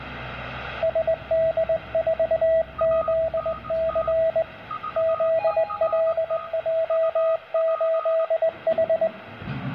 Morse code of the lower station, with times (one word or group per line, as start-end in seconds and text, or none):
0.8-4.4 SD4ZC
5.0-9.1 ZLJ8H